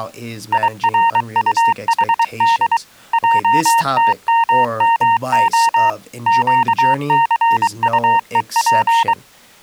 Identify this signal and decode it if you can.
Morse code (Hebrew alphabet), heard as a keyed tone, machine-sent, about 23 wpm, 920 Hz, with speech in English. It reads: ירטחד עתממה קסטוף